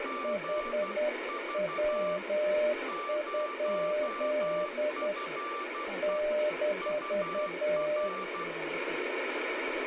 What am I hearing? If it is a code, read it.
Morse code, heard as two keyed tones, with radio static and speech in Chinese. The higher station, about 12 wpm, 1180 Hz: GV 0FE UR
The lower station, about 10 wpm, 600 Hz: HW? -